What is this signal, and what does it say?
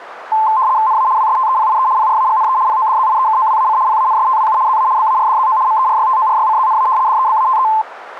RTTY (75 baud, 170 Hz shift), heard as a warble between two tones, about 960 Hz centre, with radio static. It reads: NA WSTEPIE PRAGNE PODZIEKOWAC PANSTWU ZA BARDZO MERYTORYCZNA DEBATE